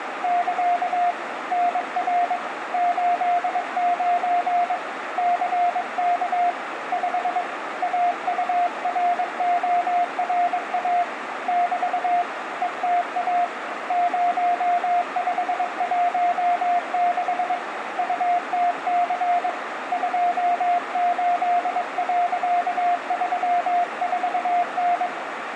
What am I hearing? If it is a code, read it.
Morse code, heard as a keyed tone, hand-sent with a paddle, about 22 wpm, 710 Hz, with radio static, a narrow filter and room echo. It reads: <KA> NR 89 CK 5 AURORA <BT> ETA 0516 UTC 28.34N